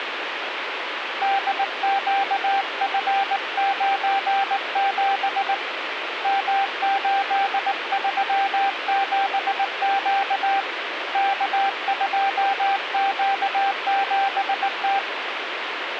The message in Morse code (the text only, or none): DQF97 M837Q K2Q7T